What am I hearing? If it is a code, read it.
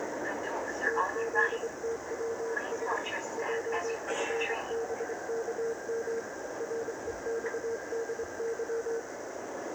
Morse code, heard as a keyed tone, hand-sent with a straight key, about 25 wpm, 460 Hz, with heavy radio static, a narrow filter and the noise inside a subway train. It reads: TZTWS JFBKM REXDY